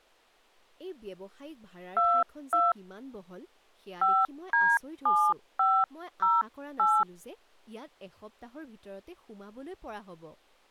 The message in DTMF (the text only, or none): 22 5D7508